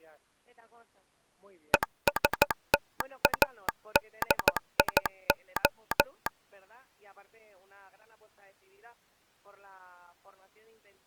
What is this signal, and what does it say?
Morse code, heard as a telegraph sounder, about 14 wpm. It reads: ESTADIO